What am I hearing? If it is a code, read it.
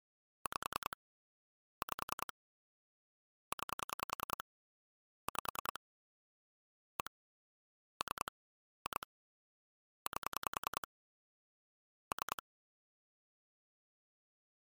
Pulse dialling, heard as clicks on a phone line, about 10 pulses a second. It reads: 5 5 9 5 1 3 2 8 3